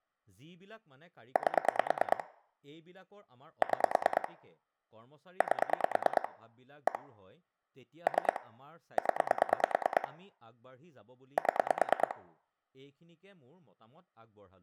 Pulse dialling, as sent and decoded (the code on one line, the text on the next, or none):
8 / 6 / 8 / 1 / 3 / 10 / 7
8 6 8 1 3 0 7